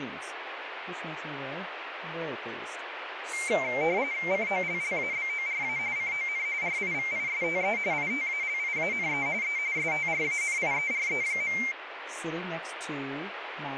RTTY (45.45 baud, 170 Hz shift), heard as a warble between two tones, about 2200 Hz centre, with radio static and speech in English. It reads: COLLABORA CON RIVISTE ITALIANE E STRANIERE.